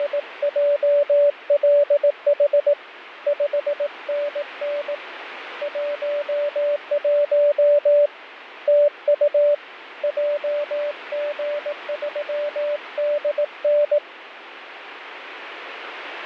Morse code, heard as a keyed tone, hand-sent with a paddle, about 18 wpm, 580 Hz, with radio static. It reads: … 5NN 11 TU JG3DN